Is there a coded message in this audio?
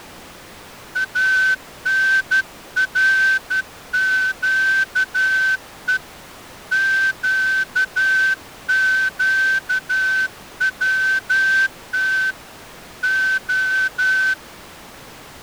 Yes: Morse code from 0.9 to 14.4 s, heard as a whistle, hand-sent with a straight key, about 12 wpm. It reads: ANRQE QQWT O